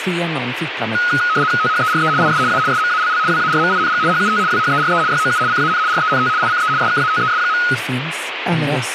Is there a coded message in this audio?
Yes: RTTY (75 baud, 170 Hz shift) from 0.9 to 7.7 s, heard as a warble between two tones, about 1360 Hz centre, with radio static and speech in Swedish. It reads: THERE IS A SMALL WARMING HUT WHERE YOU CAN RENT ICE SKATES.